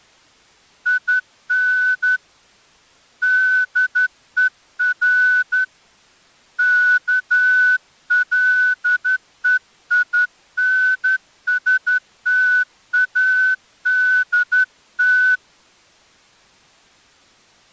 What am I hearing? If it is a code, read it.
Morse code, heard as a whistle, hand-sent with a straight key, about 11 wpm. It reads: IN DER KLEINSTADT